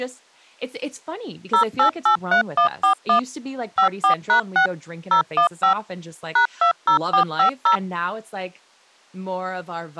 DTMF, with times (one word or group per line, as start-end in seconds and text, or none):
1.5-3.2 0883141
3.8-4.7 54#6
5.1-5.7 015
6.4-7.8 #20450